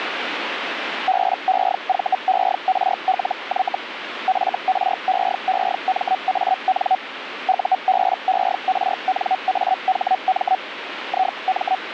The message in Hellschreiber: BEVERLY FREEMAN UBERNAHM IM

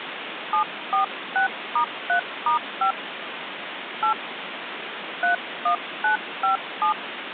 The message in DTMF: 746*3*5 8 31957

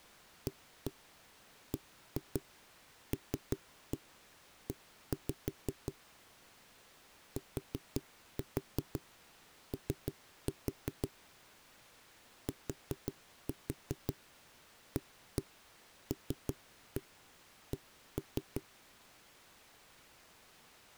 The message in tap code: ABLE TO TALK

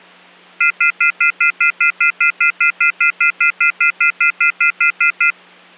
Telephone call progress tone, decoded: off-hook warning tone

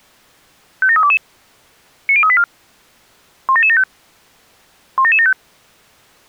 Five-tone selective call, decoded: 57322 90384 17775 17775

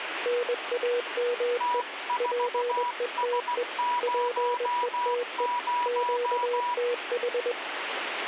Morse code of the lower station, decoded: NAME PETE PETE QTH

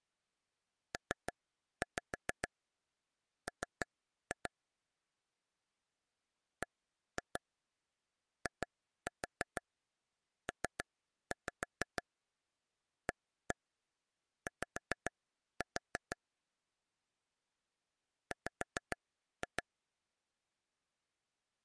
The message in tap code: PM BIPAY W

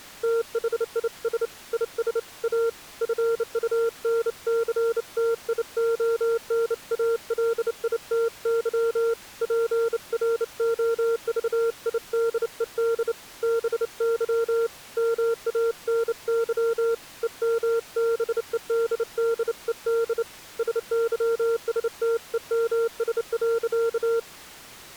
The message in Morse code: THIS IS A FUNCTIONALITY PROVIDED BY MANY EMBEDDED SYSTEMS.

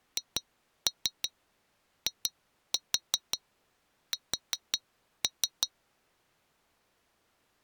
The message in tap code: HIS

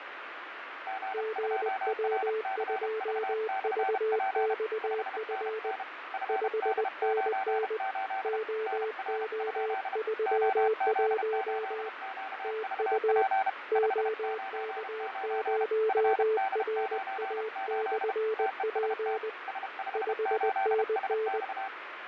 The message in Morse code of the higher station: G2RCV/P 5NN FD98 NR? OZ8QVP 599 FD98 TEST S58SX

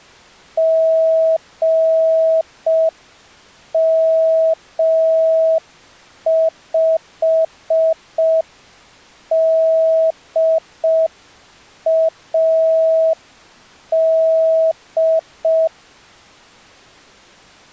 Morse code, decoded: GM5DAD

